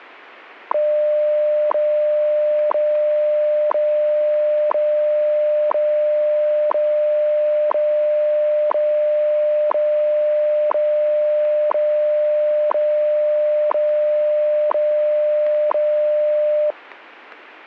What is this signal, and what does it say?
Radio time signal (WWV, Colorado), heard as ticks, one a second.